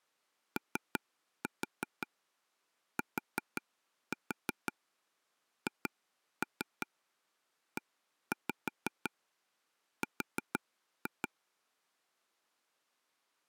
Tap code, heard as taps on a table, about 5 knocks a second. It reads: OTHER